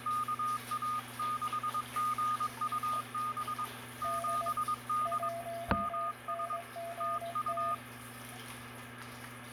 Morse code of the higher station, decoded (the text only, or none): KA6GUB 7D MS TU